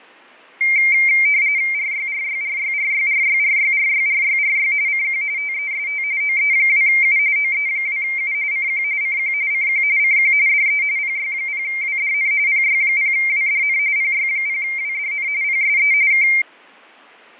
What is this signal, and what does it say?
RTTY (45.45 baud, 170 Hz shift), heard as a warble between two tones, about 2200 Hz centre, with fading. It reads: RYRYRYRYRYRYRYRYRY CQ TEST OE2U OE2U CQ CQ CQ CQ DE PY0WDN PY0WDN PY0WDN PSE K